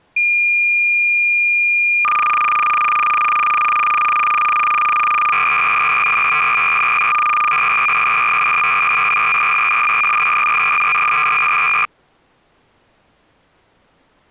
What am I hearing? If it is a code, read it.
Cassette data (Kansas City type), 300 baud, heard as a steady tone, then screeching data.